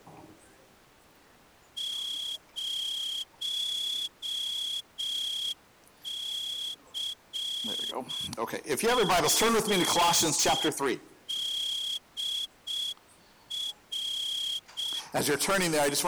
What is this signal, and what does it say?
Morse code, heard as a whistle, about 6 wpm. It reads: 0CFDR